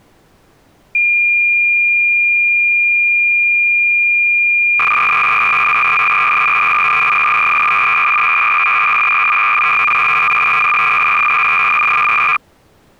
Cassette data (Kansas City type), 300 baud, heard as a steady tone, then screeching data.